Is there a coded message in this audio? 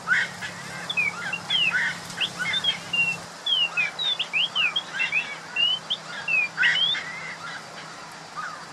No, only bird-like chirps.